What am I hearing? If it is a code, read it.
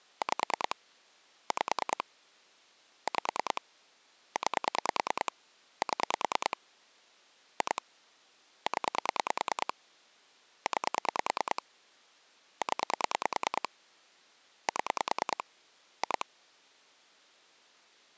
Pulse dialling, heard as clicks on a phone line, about 9 pulses a second. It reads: 5 5 5 9 7 2 0 9 0 7 2